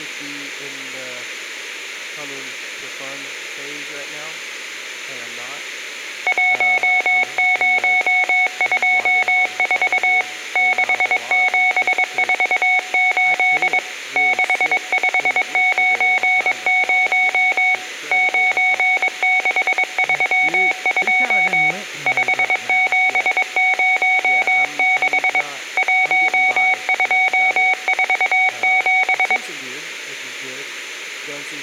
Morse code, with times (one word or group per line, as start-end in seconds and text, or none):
6.3-10.2 1024
10.6-13.8 6748
14.2-17.7 6590
18.1-21.7 9632
22.1-25.4 5706
25.8-29.4 1247